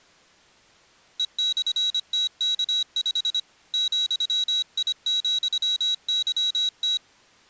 Morse code, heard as a high beeper, hand-sent with a paddle, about 25 wpm, 3850 Hz. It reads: E/TK5 ,I,YT